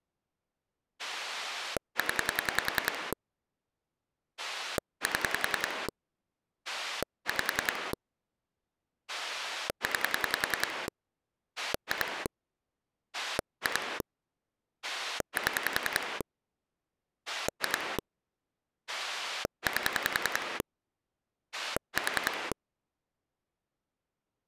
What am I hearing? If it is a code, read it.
Pulse dialling, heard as a rotary dial, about 10 pulses a second. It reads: 0 7 5 9 2 2 7 2 8 4